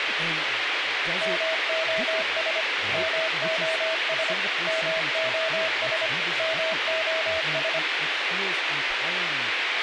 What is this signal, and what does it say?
Morse code, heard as a keyed tone, machine-sent, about 25 wpm, 650 Hz, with radio hiss, a squelch burst at the end and speech in English. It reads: MOS MOS MOS MOS